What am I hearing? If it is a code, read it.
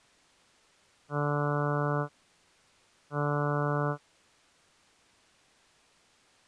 Ship horn signal, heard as a ship's horn, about 150 Hz. 2 short. At sea: I am altering course to port.